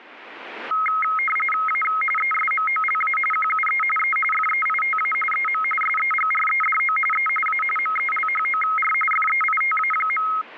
RTTY (45.45 baud, 850 Hz shift), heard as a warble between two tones, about 1700 Hz centre, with radio static. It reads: A ESMOLA QUE E FEITA EM SEGREDO E A MELHOR FEITA.